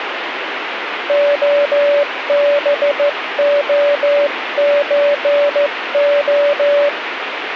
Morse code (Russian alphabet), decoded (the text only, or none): ОБОЧО